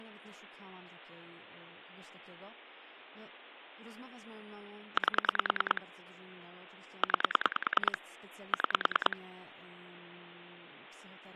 Pulse dialling, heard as clicks on a phone line, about 10 pulses a second, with speech in Polish. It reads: 8 9 6